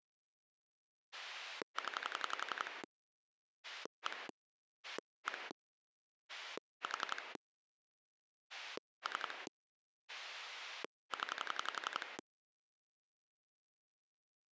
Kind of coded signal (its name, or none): pulse dialling